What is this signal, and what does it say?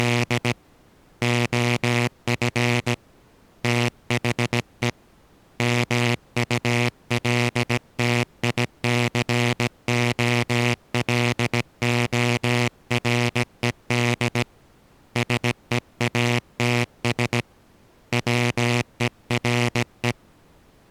Morse code, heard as a buzzer, hand-sent with a paddle, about 17 wpm. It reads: … OF THE MULTICOLORED SEATS WERE